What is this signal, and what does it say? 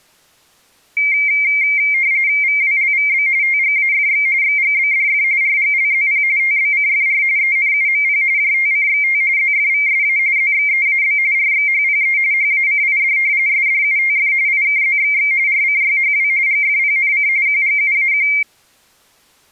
RTTY (45.45 baud, 170 Hz shift), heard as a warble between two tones, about 2200 Hz centre. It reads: VWLVB TGAFX XGBDF RGLZP TBCFR ENUMP JTCXT ZFVSA ZXEAB RXHPE HACID SDUTF IKZXX RCYHW GFPNC QGUAQ